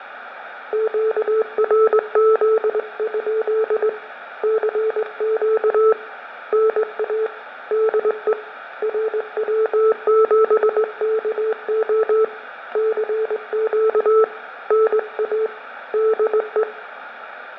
Morse code, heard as a keyed tone, hand-sent with a straight key, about 20 wpm, 440 Hz, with fading and room echo. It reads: QRZ? CQ NA DE RW7KO CQ NA DE